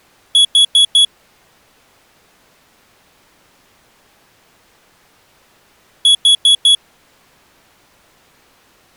Alarm pattern, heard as an alarm's beeps, played twice, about 3350 Hz. Temporal four. Carbon monoxide.